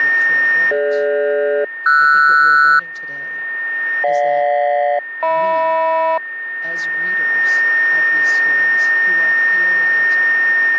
Aircraft SELCAL, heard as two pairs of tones, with a steady whistle near 1830 Hz. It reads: DG-RS GJ-HM